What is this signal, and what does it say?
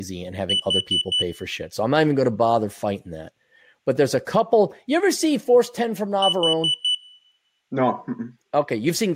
Alarm pattern, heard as an alarm's beeps, played twice, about 3000 Hz, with speech in English. Temporal four. Carbon monoxide.